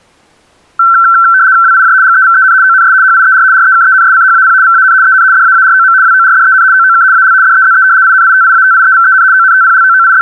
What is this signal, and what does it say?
RTTY (75 baud, 170 Hz shift), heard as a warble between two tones, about 1440 Hz centre. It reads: WIJ GEVEN ONS HIER REKENSCHAP VAN EN DAAROM WORDEN OOK AL DEZE INITIATIEVEN …